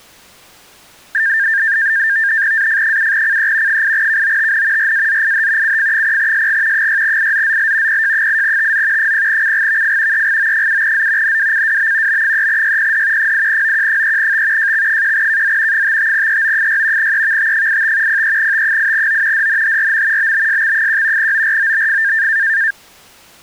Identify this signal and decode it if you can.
NAVTEX (SITOR-B), 100 baud, 170 Hz shift, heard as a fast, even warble, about 1700 Hz centre. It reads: AF7CE 8KOTN RAZIH CF0SG 6IZZL PJ8TZ 0CGVF EGO7Z NWCWB B3YPD 8OQ3T JX1KZ 55EO6 EVT85 03T8O DNHRM BBSX1 OROBF